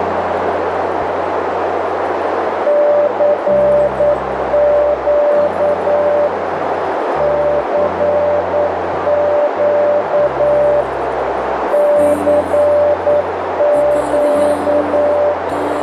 Morse code, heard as a keyed tone, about 9 wpm, 590 Hz, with heavy radio static and a narrow filter. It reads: CQ CQ CQ